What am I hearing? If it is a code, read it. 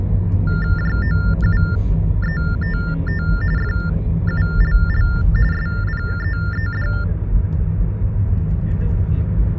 TTY/TDD text telephone tones (45.45 baud Baudot), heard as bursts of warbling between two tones, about 400 Hz shift, 1600 Hz centre, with the noise inside a car. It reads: JOUETT FULL SPEED